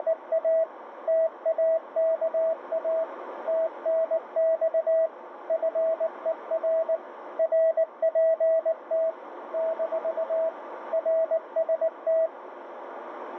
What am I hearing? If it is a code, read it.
Morse code, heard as a keyed tone, machine-sent, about 19 wpm, 650 Hz, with radio static and a narrow filter. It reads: … TAKA TNX FER RPT - RST